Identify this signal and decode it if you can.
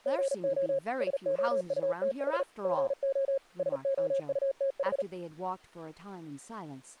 Morse code, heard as a keyed tone, machine-sent, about 38 wpm, 540 Hz, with speech in English. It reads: GO SOUTH GO SOUTH